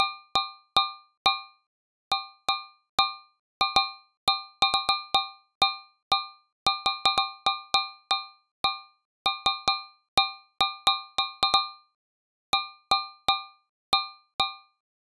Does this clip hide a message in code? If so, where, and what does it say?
No, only irregular taps on a metal pipe.